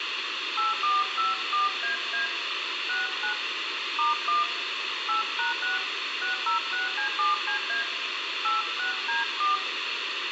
DTMF, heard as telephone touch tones, dialled by hand, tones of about 150 ms, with radio hiss and room echo. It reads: 8454AA 69 *1 8#6 606C7CA 86D4